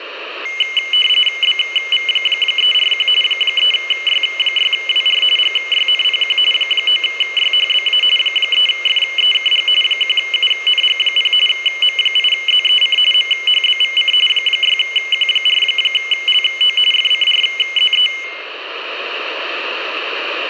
RTTY (45.45 baud, 850 Hz shift), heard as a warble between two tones, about 2550 Hz centre, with radio static. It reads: BV341 3Y6WR GYNPQ 9YHBA 3FEKG 1UNG0 M8ZEC MHBVC 6Q4LO FCRZE